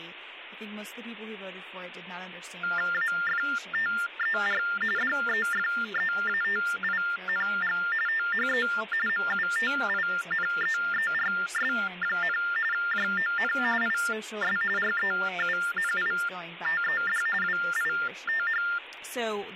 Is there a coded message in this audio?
Yes: TTY/TDD text telephone tones (45.45 baud Baudot) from 2.6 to 18.8 s, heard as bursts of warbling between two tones, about 400 Hz shift, 1600 Hz centre, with phone line noise and speech in English. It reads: AFTER DEFEATING THE MUTINEERS, JON IS REUNITED WITH